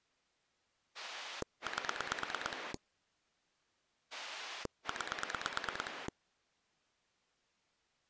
Pulse dialling, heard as a rotary dial, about 9 pulses a second. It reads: 8 9